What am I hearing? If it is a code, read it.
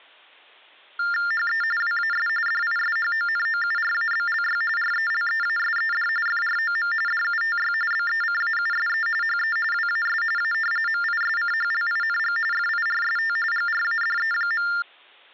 TTY/TDD text telephone tones (45.45 baud Baudot), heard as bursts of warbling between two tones, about 400 Hz shift, 1600 Hz centre. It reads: HE WAS DISHONOURABLY RELEASED FROM DUTY BECAUSE HE WAS A MISCHLING FIRST GRADE.